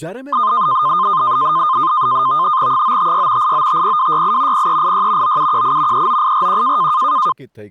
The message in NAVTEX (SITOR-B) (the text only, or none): 956 8950268 0386 9718 39841